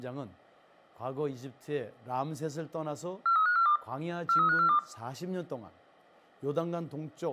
Five-tone selective call (CCIR), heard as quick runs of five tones, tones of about 100 ms, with room echo and speech in Korean. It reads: 43542 43542